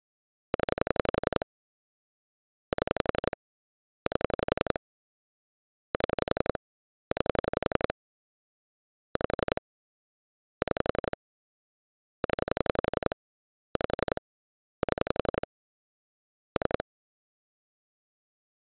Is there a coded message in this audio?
Yes: pulse dialling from 0.5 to 16.8 s, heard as clicks on a phone line, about 11 pulses a second. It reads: 0 7 8 7 9 5 6 0 5 7 3